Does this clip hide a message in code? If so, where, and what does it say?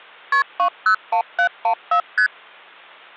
Yes: multi-frequency trunk signalling (R1, as on North American trunks) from 0.3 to 2.3 s, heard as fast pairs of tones, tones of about 90 ms. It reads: KP 201714 ST